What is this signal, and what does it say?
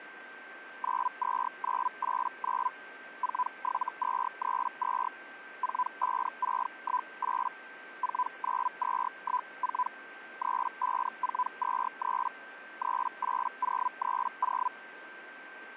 Hellschreiber (Feld-Hell, 122.5 baud), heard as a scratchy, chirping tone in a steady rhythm, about 1000 Hz, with a steady whistle near 1560 Hz. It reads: 92989 47232 45618 49214 35423 38030